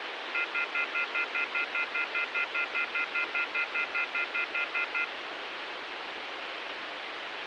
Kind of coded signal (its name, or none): telephone call progress tone